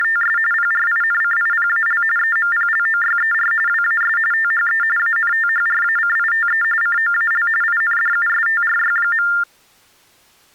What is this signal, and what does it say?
TTY/TDD text telephone tones (45.45 baud Baudot), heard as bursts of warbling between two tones, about 400 Hz shift, 1600 Hz centre. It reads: … PRINCIPAL EMPLOYER WAS THE ANTHRACITE COAL INDUSTRY.